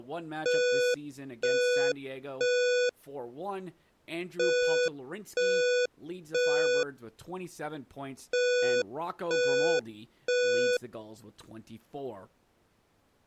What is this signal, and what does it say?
Alarm pattern, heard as an alarm's beeps, played three times, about 490 Hz, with speech in English. Temporal three. Smoke or fire, evacuate.